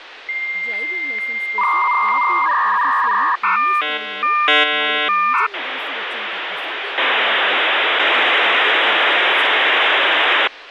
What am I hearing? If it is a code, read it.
Dial-up modem handshake (V.34 or later), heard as a whistle, warbles, then hiss, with phone line noise and speech in Telugu.